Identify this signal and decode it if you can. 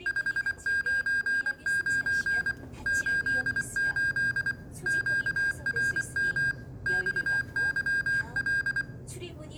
Morse code, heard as electronic beeps, machine-sent, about 24 wpm, 1600 Hz, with the noise inside a subway train. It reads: 599 88 QRM XYL